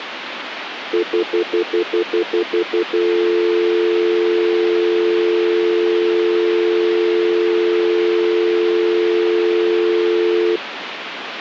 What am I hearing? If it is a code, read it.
Telephone call progress tone (North American plan), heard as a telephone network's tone, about 350, 440 Hz, 0.1 s on and 0.1 s off, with phone line noise. Stutter dial tone.